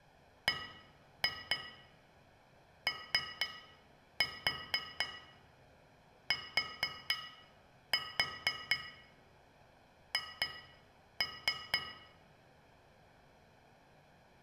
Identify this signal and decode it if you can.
Tap code, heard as taps on glass, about 4 knocks a second, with room echo. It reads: BOTH